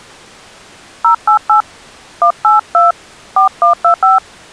DTMF, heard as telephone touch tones, dialled by hand, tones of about 120 ms. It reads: 088 182 4125